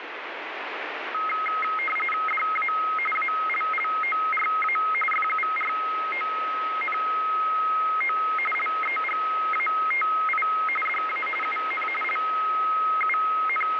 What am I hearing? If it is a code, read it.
RTTY (45.45 baud, 850 Hz shift), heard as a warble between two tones, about 1700 Hz centre, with radio static. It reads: DA ALLORA FURONO LEGATI DA UN …